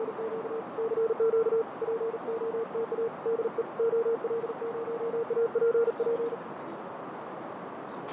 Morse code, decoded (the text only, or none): … CQ POTA DE OL0APP